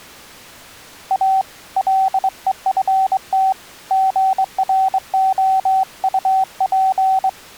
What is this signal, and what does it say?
Morse code, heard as a keyed tone, hand-sent with a straight key, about 23 wpm, 770 Hz. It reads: A LEFT GROUP